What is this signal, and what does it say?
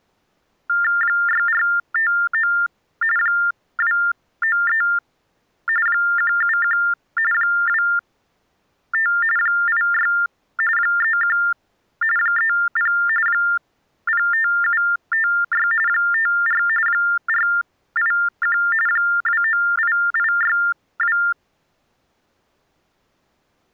TTY/TDD text telephone tones (45.45 baud Baudot), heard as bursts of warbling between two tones, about 400 Hz shift, 1600 Hz centre. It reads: 6459 293 171 25 86 31 30 05756 54 481 298862